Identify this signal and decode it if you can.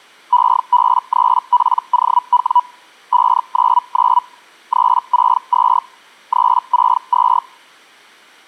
Hellschreiber (Feld-Hell, 122.5 baud), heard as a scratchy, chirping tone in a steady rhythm, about 980 Hz. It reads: EB3POW 599 362 362